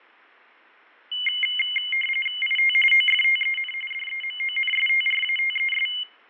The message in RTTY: IT OFTEN DEMONSTRATES

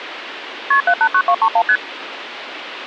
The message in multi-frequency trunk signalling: KP 789231 ST

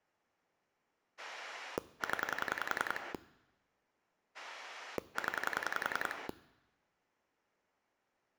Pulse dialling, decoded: 0 0

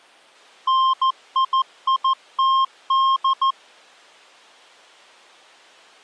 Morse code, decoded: NIITD

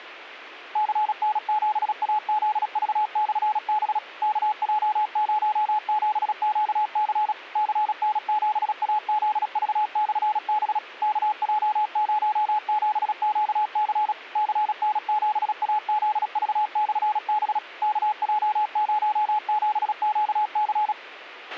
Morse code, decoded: CN7AZV/B KJ07QC CN7AZV/B KJ07QC CN7AZV/B KJ07QC

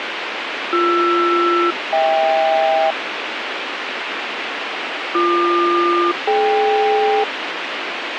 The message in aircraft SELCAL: BR-HK BQ-DK

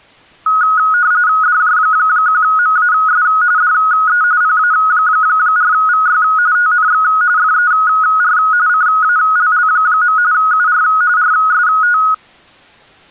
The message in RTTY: DJ1MAS DE PA4VY TNX FER CALL. UR RST

